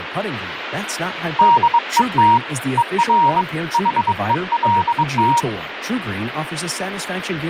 Morse code, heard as a keyed tone, hand-sent with a bug key, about 22 wpm, 940 Hz, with radio static and speech in English. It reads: DET ER HELT